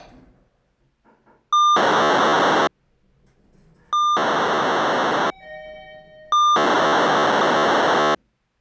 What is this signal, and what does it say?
POCSAG pager data (2400 baud), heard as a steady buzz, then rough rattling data, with the noise inside a lift.